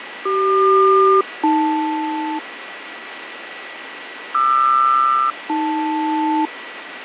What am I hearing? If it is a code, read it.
Aircraft SELCAL, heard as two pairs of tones, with radio static, fading and a steady whistle near 1950 Hz. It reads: CQ-AL QR-AL